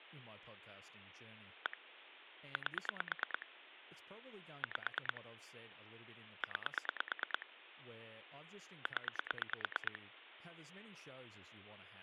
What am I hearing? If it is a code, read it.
Pulse dialling, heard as clicks on a phone line, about 9 pulses a second, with phone line noise and speech in English. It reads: 1 8 5 9 0